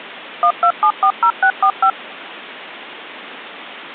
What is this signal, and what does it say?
DTMF, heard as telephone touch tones, dialled by machine, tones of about 80 ms. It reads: 12740645